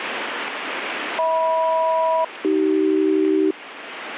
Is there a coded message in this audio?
Yes: aircraft SELCAL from 1.2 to 3.5 s, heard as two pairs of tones, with radio static. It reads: HM-AC